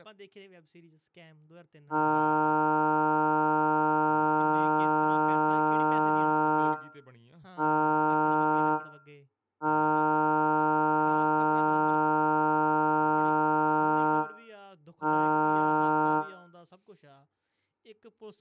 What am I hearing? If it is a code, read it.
Ship horn signal, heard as a ship's horn, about 150 Hz, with room echo and speech in English. 1 long, 1 short, 1 long, 1 short. At sea: I agree to be overtaken.